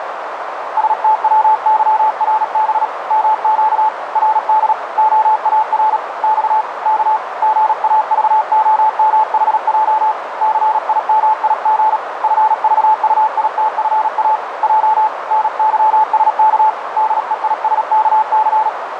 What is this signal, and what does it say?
Morse code, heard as a keyed tone, hand-sent with a paddle, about 37 wpm, 870 Hz, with radio static and a narrow filter. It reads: STWYRB MQ RD OAR X K GAVOMHJ CIMIG FVUITFA J NYSK DEISKC